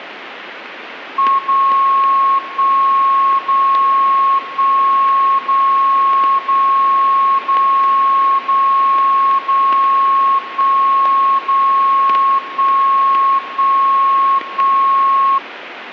Radio time signal (DCF77), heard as a tone whose level steps once a second, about 1090 Hz. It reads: 0 1 0 1 0 0 0 0 0 1 0 1 1 1